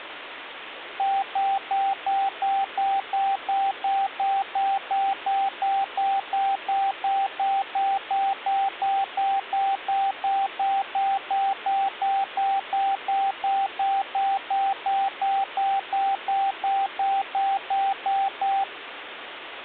Evenly repeated beeps, with phone line noise. There is no code.